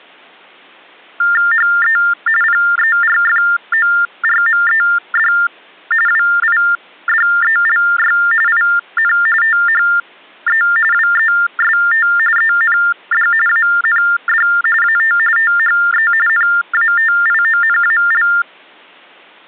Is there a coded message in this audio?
Yes: TTY/TDD text telephone tones (45.45 baud Baudot) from 1.2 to 18.4 s, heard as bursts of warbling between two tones, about 400 Hz shift, 1600 Hz centre. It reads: HE PERFORMED WIDELY IN THE WEST END AND AT THE NATIONAL